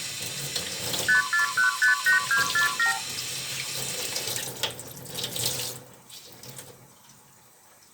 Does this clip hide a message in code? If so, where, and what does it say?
Yes: multi-frequency trunk signalling (R2, with the far end's replies) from 1.1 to 3.0 s, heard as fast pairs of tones, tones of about 120 ms, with room echo and kitchen noise. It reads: 54158247